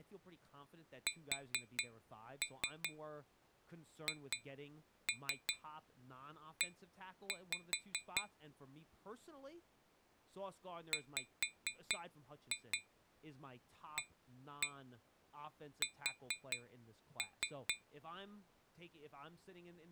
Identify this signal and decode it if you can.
Tap code, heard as taps on glass, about 4 knocks a second, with speech in English. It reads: SHE WAS